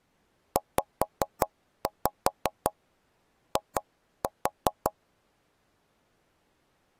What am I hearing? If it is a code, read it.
Tap code, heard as knocks on wood, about 5 knocks a second. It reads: ZI